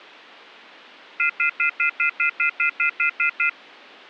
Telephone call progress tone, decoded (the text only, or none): off-hook warning tone